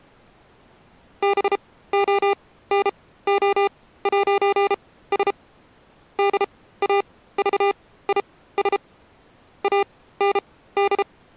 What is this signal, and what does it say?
Morse code, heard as electronic beeps, machine-sent, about 33 wpm, spaced as for 17 wpm, 400 Hz. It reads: BONO'S DAVIS AND